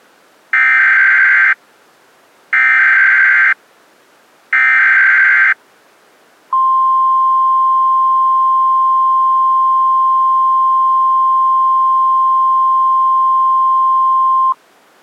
Emergency Alert System (SAME) tones (header bursts, then the 1050 Hz attention tone), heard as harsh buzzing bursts, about 520.83 baud.